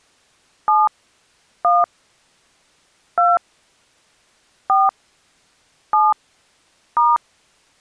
DTMF, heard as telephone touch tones, dialled by hand, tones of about 190 ms. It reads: 7 1 2 4 7 *